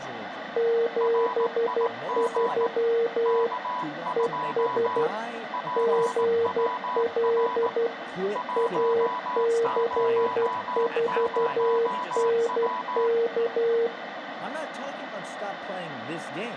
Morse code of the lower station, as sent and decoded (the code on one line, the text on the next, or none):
--... ...-- / . ... / --. .-.. / .- -.-. ....- -. -.-
73 ES GL AC4NK